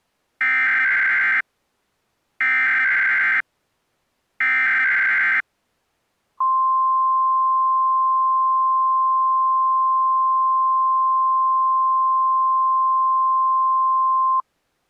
Emergency Alert System (SAME) tones (header bursts, then the 1050 Hz attention tone), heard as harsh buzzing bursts, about 520.83 baud.